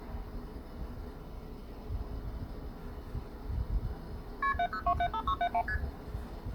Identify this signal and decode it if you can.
Multi-frequency trunk signalling (R1, as on North American trunks), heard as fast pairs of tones, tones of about 70 ms, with the noise inside a lift. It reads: KP 70275671 ST